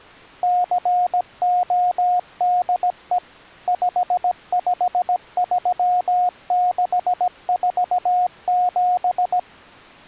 Morse code, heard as a keyed tone, machine-sent, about 17 wpm, 720 Hz. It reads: CODE 553647